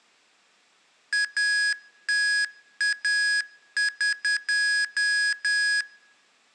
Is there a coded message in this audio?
Yes: Morse code (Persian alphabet) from 1.1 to 5.9 s, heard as electronic beeps, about 10 wpm, 1650 Hz, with room echo. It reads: اتاق